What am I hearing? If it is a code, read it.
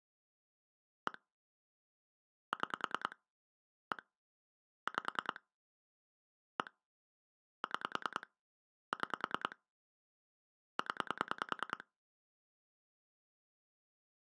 Pulse dialling, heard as clicks on a phone line, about 10 pulses a second. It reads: 1 6 1 5 1 6 6 0